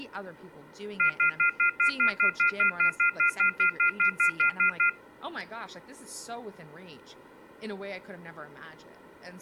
Telephone call progress tone (North American plan), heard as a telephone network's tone, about 1400, 2050, 2450, 2600 Hz, 0.1 s on and 0.1 s off, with speech in English. Off-hook warning tone.